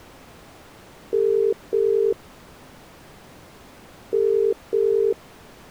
Telephone call progress tone (as in the UK, Ireland, Australia and similar networks), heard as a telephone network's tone, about 400, 450 Hz. Ringback tone.